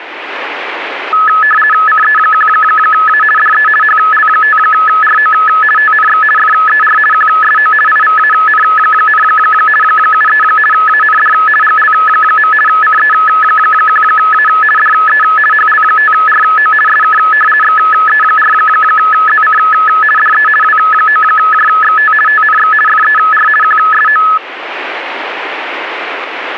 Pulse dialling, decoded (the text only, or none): none